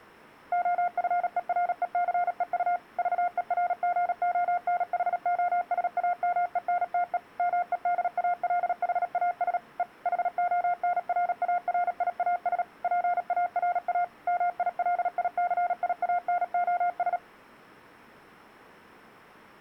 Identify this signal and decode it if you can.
Morse code, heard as a keyed tone, machine-sent, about 37 wpm, 710 Hz. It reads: OFERECEU VERGONHOSAMENTE MEDALHAS E HONRARIAS PARA MILICIANOS